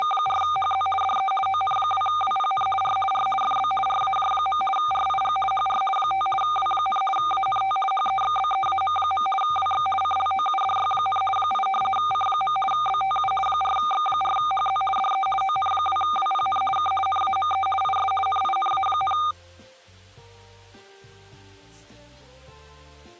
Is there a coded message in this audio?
Yes: RTTY (50 baud, 450 Hz shift) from 0.0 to 19.3 s, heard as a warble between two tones, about 1000 Hz centre. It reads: … DE ON2WPN R R FB RAJ. RIG HR 5 W, ANT HEXBEAM. WX CLOUDY, 8 C. BTU 4X4HZ DE ON2WPN K NAME IS NINA,